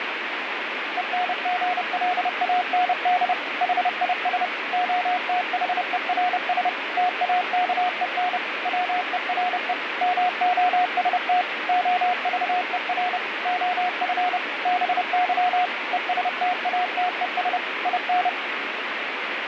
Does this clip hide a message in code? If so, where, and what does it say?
Yes: Morse code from 0.9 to 18.4 s, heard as a keyed tone, machine-sent, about 30 wpm, 720 Hz, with radio static. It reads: ENGLAND HIS OTHERS TAKEN WERE MOST OVER OF BY ESTATES IN